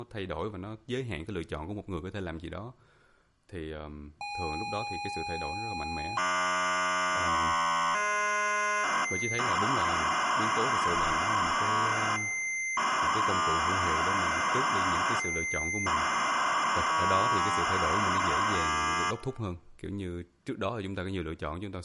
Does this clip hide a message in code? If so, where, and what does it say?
Yes: ZX Spectrum tape loading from 4.2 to 19.1 s, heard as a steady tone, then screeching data, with speech in Vietnamese.